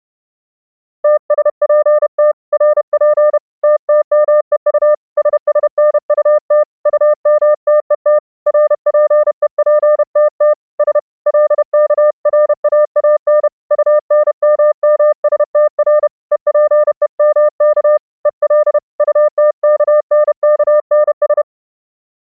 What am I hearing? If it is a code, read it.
Morse code, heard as a keyed tone, hand-sent with a paddle, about 31 wpm, 600 Hz. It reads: TSPT RP TTMEU SSNUT UMTET RPEPTT S LKRAAN UNMMSTR EPEMK EL UTKNKNS